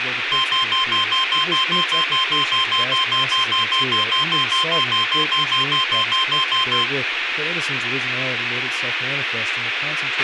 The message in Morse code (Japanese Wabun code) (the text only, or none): none